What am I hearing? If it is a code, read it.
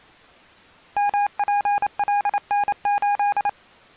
Morse code, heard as a keyed tone, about 28 wpm, 820 Hz. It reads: MPLN8